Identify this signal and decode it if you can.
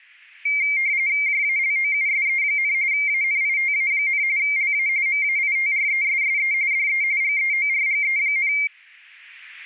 RTTY (45.45 baud, 170 Hz shift), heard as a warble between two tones, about 2200 Hz centre. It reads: JALOUSE, ANITA, LA MAITRESSE DE GEORGE,